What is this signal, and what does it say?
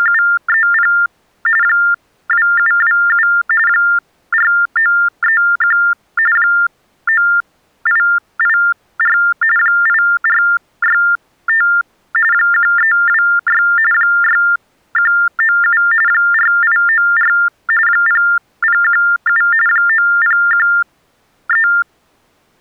TTY/TDD text telephone tones (45.45 baud Baudot), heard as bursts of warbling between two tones, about 400 Hz shift, 1600 Hz centre. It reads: … 2727 4931 9884 8465 1326 6197 4894 0017 9013